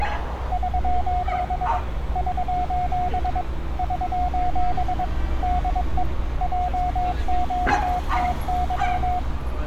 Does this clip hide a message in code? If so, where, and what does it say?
Yes: Morse code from 0.5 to 9.3 s, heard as a keyed tone, machine-sent, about 22 wpm, 720 Hz, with radio static and street noise. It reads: <SOS> <SOS> <SOS> DE JQTY